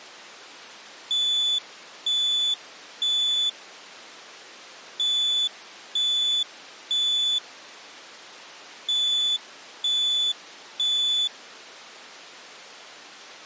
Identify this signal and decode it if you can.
Alarm pattern, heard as an alarm's beeps, played three times, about 3500 Hz. Temporal three. Smoke or fire, evacuate.